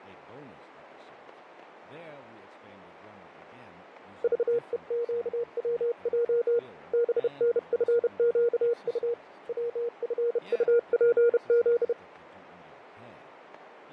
Morse code, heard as a keyed tone, hand-sent with a bug key, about 31 wpm, 470 Hz, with radio static, fading and speech in English. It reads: VEQWJ BNFQU WFUPZ